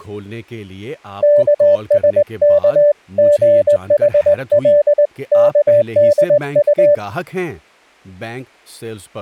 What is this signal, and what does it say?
Morse code (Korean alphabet), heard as a keyed tone, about 20 wpm, 590 Hz, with speech in Urdu. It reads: 영숙의